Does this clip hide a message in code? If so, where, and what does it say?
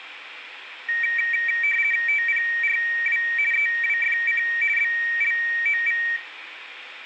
Yes: RTTY (50 baud, 450 Hz shift) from 0.9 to 6.2 s, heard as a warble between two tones, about 2100 Hz centre, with radio static and room echo. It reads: TPRW EWFC BLOV